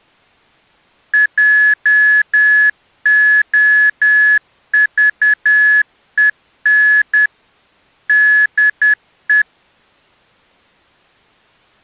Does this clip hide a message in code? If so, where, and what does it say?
Yes: Morse code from 1.1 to 9.5 s, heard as electronic beeps, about 10 wpm, 1700 Hz. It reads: JOVEN DE